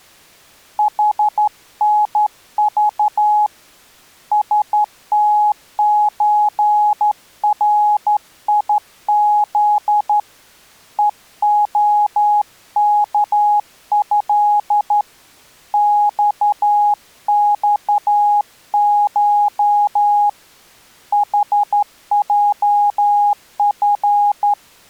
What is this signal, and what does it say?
Morse code (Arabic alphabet), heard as a keyed tone, hand-sent with a straight key, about 12 wpm, 830 Hz. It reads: حنض ستزريذ ءخكه صصش حجف